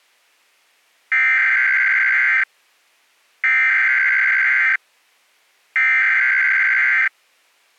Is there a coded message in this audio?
Yes: Emergency Alert System (SAME) tones (header bursts) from 1.1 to 7.1 s, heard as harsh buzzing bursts, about 520.83 baud.